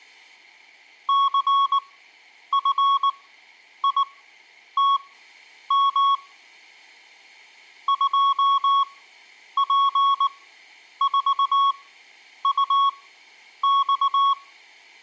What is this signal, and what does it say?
Morse code, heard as a keyed tone, machine-sent, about 19 wpm, spaced as for 9 wpm, 1110 Hz. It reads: CFITM 2P4UX